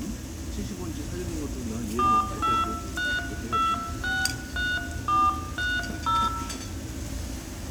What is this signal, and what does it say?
DTMF, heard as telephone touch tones, dialled by hand, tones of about 220 ms, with hum, room echo and the noise of a crowd indoors. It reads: 423263430